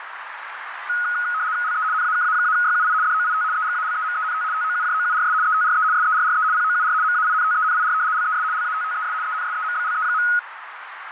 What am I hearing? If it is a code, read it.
RTTY (75 baud, 170 Hz shift), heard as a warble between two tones, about 1360 Hz centre, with radio static and a narrow filter. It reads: LE NAKA-YUI DOIT EGALEMENT TOUJOURS ETRE SERRE POUR MAINTENIR LES LATTES ENSEMBLE.